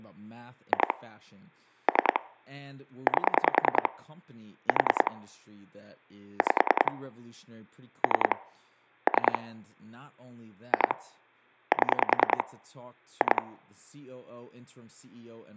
Pulse dialling, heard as clicks on a phone line, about 10 pulses a second, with speech in English. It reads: 2 3 8 4 5 3 3 2 7 2